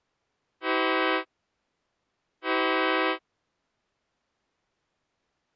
Train horn signal, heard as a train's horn. 2 short. On North American railways: a signal is acknowledged.